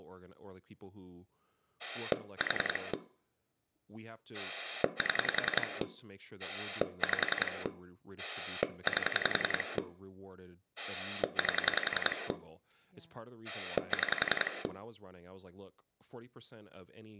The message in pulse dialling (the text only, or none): 4 7 5 8 8 6